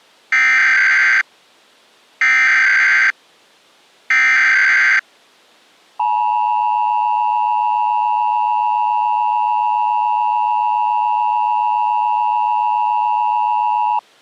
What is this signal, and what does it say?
Emergency Alert System (SAME) tones (header bursts, then the 853 and 960 Hz attention tone), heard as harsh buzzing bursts, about 520.83 baud.